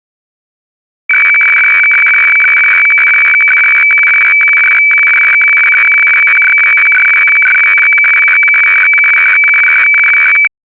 Weather fax (radiofax), 120 lines a minute, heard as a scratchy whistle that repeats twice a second.